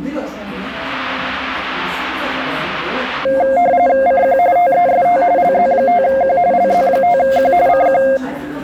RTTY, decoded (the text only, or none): CQ TEST LZ5Q LZ5Q CQ